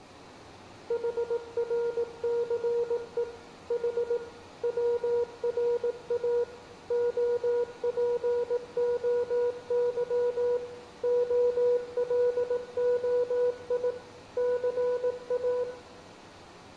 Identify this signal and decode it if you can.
Morse code (Greek alphabet), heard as a keyed tone, machine-sent, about 18 wpm, 480 Hz, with room echo. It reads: ΗΡΘΕ Η ΩΡΑ ΟΠΟΥ ΟΛΟΙ ΘΑ